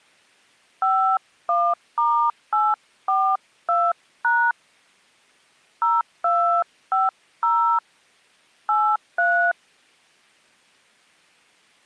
DTMF, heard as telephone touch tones, dialled by hand, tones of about 290 ms. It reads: 51*842# 0250 83